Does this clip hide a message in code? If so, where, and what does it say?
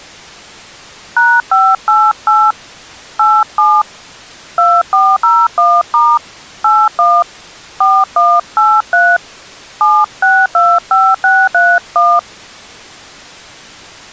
Yes: DTMF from 1.2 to 12.2 s, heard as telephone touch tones, dialled by hand, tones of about 240 ms. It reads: #588 87 2401* 81 4183 7625631